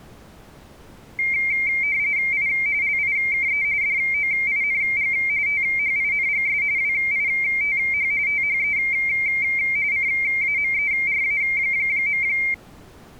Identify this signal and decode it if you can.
RTTY (45.45 baud, 170 Hz shift), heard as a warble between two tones, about 2200 Hz centre. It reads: I LIKE DOING THINGS WITH THE CAMERA.